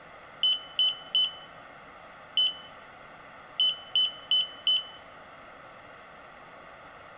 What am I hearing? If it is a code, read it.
Beep code, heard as a piezo beeper, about 3000 Hz, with room echo. 3-1-4. In Phoenix BIOS tables: interrupt mask register failure.